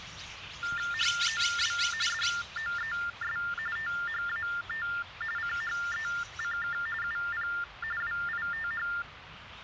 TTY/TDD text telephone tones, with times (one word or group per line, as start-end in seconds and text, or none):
0.9-1.8 HOW
2.1-3.4 DOES
3.8-4.9 THAT
5.4-6.8 CHECK
7.0-7.5 UP
8.0-8.9 WITH